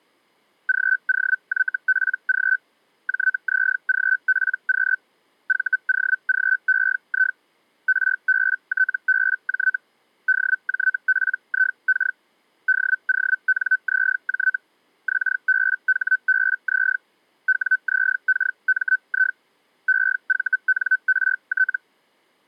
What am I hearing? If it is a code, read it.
Hellschreiber (Feld-Hell, 122.5 baud), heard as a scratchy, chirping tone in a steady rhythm, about 1500 Hz. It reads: GOYPG JZGPQ VOGEI RBTBJ DJPIK DONZJ XBHBZ WZKMI EVNRT